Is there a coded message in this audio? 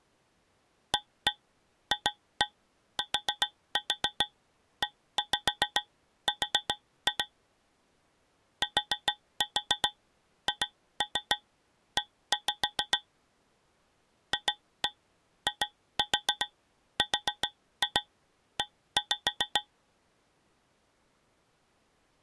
Yes: tap code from 0.9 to 19.7 s, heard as taps on a metal pipe, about 7 knocks a second. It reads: AFTER THE FIRE